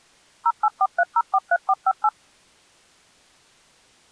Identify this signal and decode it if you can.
DTMF, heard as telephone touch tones, dialled by machine, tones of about 50 ms. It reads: 0843043458